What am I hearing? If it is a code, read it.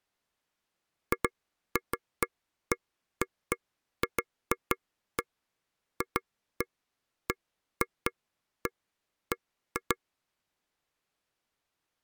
Irregular taps on a table. There is no code.